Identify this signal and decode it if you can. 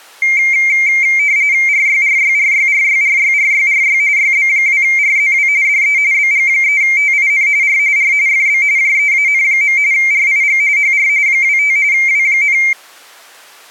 RTTY (45.45 baud, 170 Hz shift), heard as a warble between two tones, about 2200 Hz centre. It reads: RYRYRYRYRYRYRY YB2RZW DE BG3TIN R R FB JEAN. RIG HR 25 W,